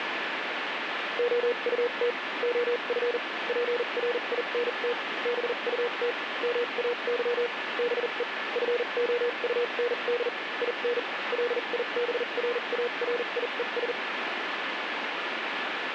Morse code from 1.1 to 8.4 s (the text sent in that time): OUT OF PRINT BUT MAY BE